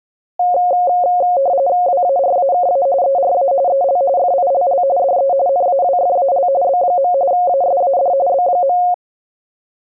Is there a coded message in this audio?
Yes: RTTY (45.45 baud, 170 Hz shift) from 0.4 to 8.9 s, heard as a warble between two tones, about 630 Hz centre. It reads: WARAKA ERA EL FILL DE NAWFAL B. ASAD B.